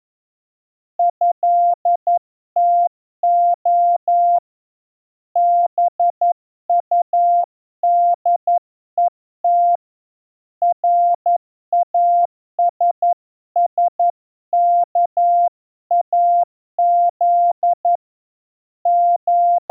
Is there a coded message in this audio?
Yes: Morse code (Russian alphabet) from 0.9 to 19.7 s, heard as a keyed tone, hand-sent with a paddle, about 11 wpm, 700 Hz. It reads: ЭТО БУДЕТ РАССКАЗ …